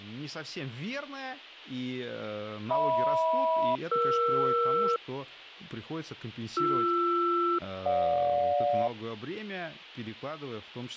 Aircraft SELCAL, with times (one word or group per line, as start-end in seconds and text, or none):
2.7-5.0 HM-ER
6.6-8.9 BR-GJ